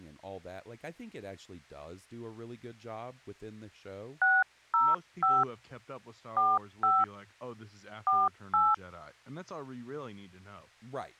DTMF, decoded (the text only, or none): 605 45 48